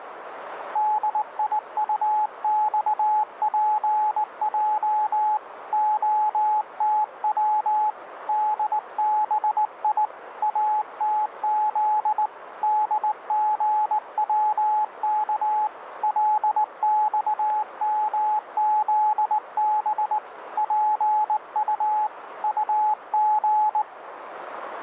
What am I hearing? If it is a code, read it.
Morse code, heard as a keyed tone, hand-sent with a straight key, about 19 wpm, 850 Hz, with radio static and a narrow filter. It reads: DIUXPJ OTW DBI ATZ DGWK LXMZB PU UG